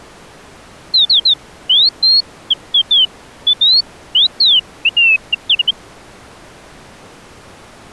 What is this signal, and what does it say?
Bird-like chirps. There is no code.